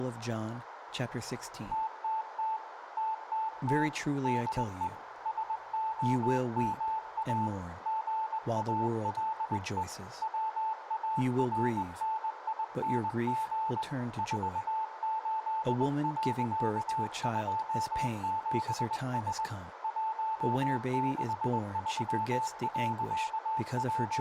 Morse code, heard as a keyed tone, hand-sent with a straight key, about 20 wpm, 880 Hz, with radio static, a narrow filter, room echo and speech in English. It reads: TTT TTT DE SOMA GALE WARNING 48.27S …